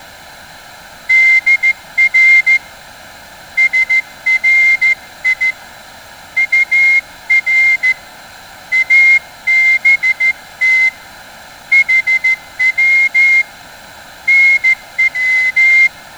Morse code, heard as a whistle, hand-sent with a straight key, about 14 wpm, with room echo. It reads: DR SRI UR ABT HW NW